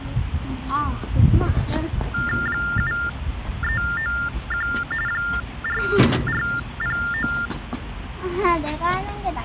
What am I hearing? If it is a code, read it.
TTY/TDD text telephone tones (45.45 baud Baudot), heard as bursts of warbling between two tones, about 400 Hz shift, 1600 Hz centre, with phone line noise and the noise of a park. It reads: 7391 4409